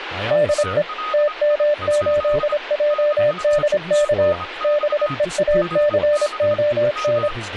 Morse code, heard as a keyed tone, machine-sent, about 26 wpm, 590 Hz, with a weaker station near 1250 Hz and speech in English. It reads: DE TM8JDK BEACON